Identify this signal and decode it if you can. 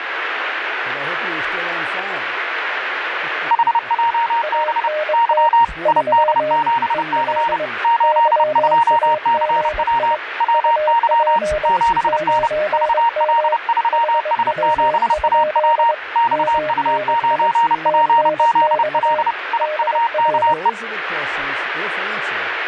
Morse code, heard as two keyed tones, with radio static. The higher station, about 30 wpm, 930 Hz: HJB Y ID7C 82CW WY 7N VL3S7AW XU9PZL IUKE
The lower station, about 22 wpm, 610 Hz: ANT 3 EL YAGI UP 9M HW? MNI TNX DR